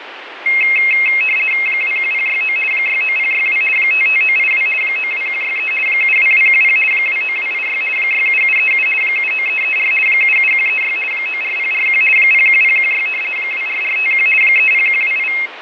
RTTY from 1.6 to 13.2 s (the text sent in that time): 21069 69062 55982 92163 72210 29286 67737 79334 77136 94041 01016